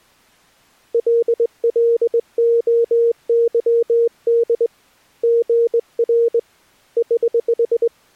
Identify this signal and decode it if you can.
Morse code, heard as a keyed tone, hand-sent with a straight key, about 20 wpm, 470 Hz. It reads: LLOYD GR <HH>